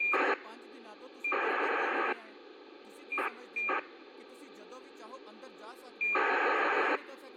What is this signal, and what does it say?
ACARS aircraft data, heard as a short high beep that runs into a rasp, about 2400 baud, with speech in Punjabi.